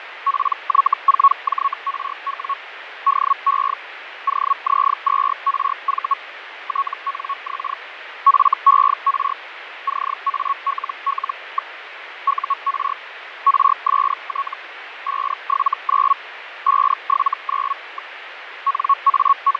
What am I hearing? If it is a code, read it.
Hellschreiber (Feld-Hell, 122.5 baud), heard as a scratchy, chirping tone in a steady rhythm, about 1110 Hz, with radio static and fading. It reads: PY4JRW DE OZ2RV TNX FER CALL. UR RST 579 579. …